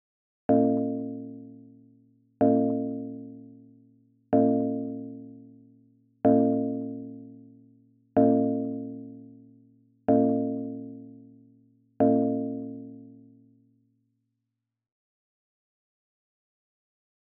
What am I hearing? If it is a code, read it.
Clock strike, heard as a bell, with room echo. 7. Seven o'clock.